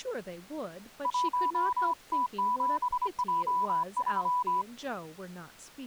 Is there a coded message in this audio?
Yes: Morse code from 1.0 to 4.7 s, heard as a keyed tone, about 25 wpm, 990 Hz, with speech in English. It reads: 1T7J3